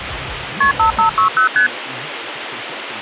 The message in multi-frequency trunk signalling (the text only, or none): KP 5560 ST